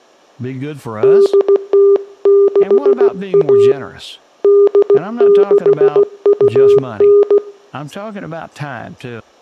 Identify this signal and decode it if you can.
Morse code (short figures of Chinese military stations), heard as a keyed tone, hand-sent with a paddle, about 16 wpm, 400 Hz, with speech in English. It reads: 8061 8629